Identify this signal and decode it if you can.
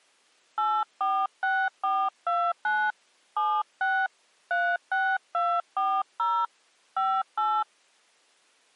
DTMF, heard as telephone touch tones, dialled by hand, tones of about 250 ms. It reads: 846429 76 36240 58